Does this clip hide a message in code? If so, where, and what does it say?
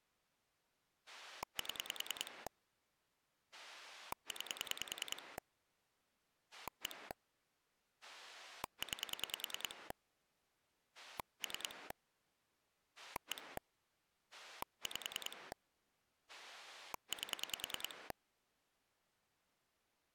Yes: pulse dialling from 1.1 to 18.1 s, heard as a rotary dial, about 10 pulses a second. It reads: 7 9 1 9 3 1 5 8